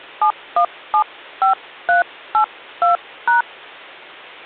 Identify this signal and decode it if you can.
DTMF, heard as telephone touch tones, dialled by hand, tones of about 100 ms, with hum. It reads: 7175382#